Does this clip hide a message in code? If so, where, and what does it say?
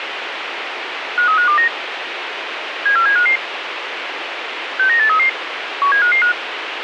Yes: five-tone selective call (CCIR) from 1.2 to 6.3 s, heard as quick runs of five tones, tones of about 100 ms, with radio hiss. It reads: 53529 74755 69833 17555